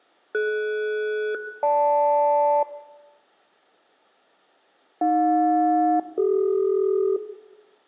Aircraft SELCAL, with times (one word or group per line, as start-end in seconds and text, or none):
0.3-2.6 DS-GL
5.0-7.2 AJ-CD